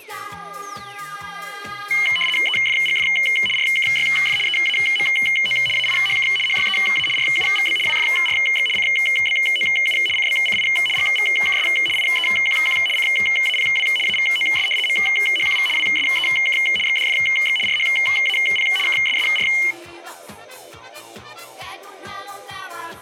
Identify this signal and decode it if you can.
RTTY (75 baud, 850 Hz shift), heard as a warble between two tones, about 2550 Hz centre. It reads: EFGF RKYF EAMO AIHK HYEA RUVB WFRX CBOU CBCI GVKS IEQQ CAPW AVOS MHQV WSEK XDFX RHAP KSSR